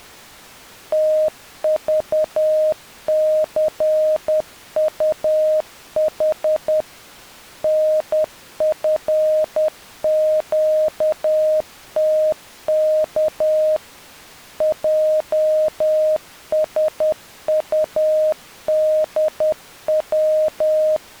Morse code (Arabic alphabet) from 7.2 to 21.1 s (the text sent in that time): نفقتك جسطدو